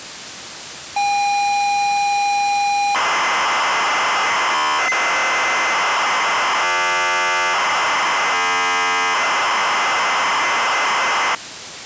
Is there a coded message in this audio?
Yes: ZX Spectrum tape loading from 1.0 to 11.4 s, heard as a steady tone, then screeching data.